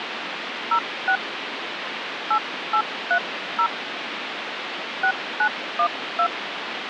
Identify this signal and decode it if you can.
DTMF, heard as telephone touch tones, dialled by hand, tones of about 80 ms, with phone line noise. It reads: 06 8830 6912